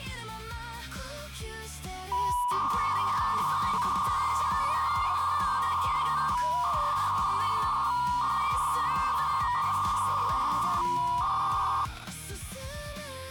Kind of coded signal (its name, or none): 300-baud modem data